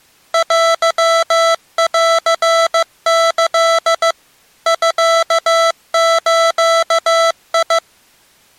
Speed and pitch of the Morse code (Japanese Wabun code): 15 wpm, 660 Hz

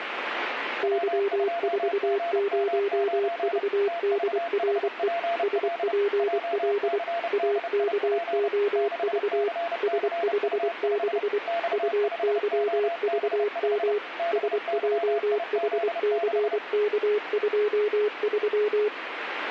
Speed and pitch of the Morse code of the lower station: 24 wpm, 410 Hz

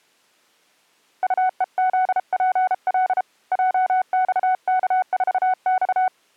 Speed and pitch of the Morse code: 33 wpm, 740 Hz

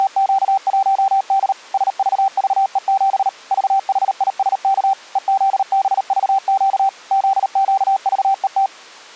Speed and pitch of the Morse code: 38 wpm, 780 Hz

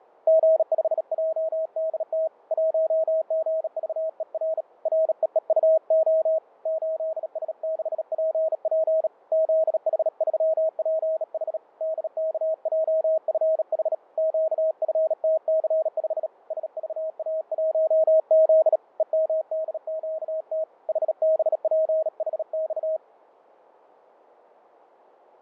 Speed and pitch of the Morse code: 37 wpm, 640 Hz

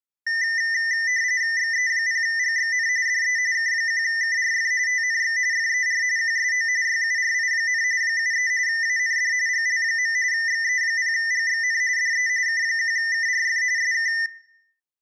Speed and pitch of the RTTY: 45.45 baud, 170 Hz shift, 1900 Hz centre

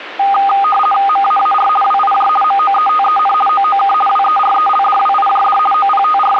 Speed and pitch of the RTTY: 50 baud, 450 Hz shift, 1020 Hz centre

